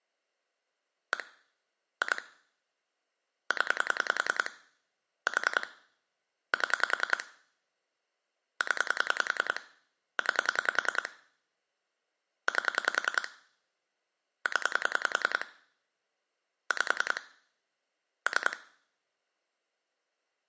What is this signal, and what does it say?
Pulse dialling, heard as clicks on a phone line, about 10 pulses a second, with room echo. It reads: 1 2 0 4 7 0 9 8 0 5 3